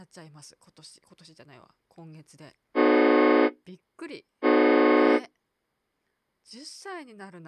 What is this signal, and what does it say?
Train horn signal, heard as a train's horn, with speech in Japanese. 2 short. On North American railways: a signal is acknowledged.